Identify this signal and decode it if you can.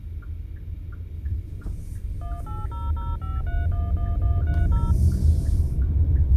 DTMF, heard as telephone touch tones, dialled by machine, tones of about 190 ms, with the noise inside a car. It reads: 18005311130